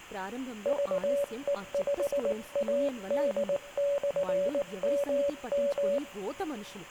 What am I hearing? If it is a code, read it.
Morse code, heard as a keyed tone, hand-sent with a paddle, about 19 wpm, 570 Hz, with room echo and speech in Telugu. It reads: VE5AD/MM